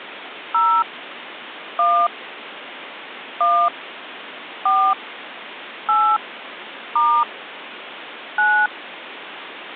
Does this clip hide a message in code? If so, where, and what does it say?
Yes: DTMF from 0.5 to 8.7 s, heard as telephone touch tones, dialled by hand, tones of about 280 ms, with phone line noise. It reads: 0 1 1 4 8 * 9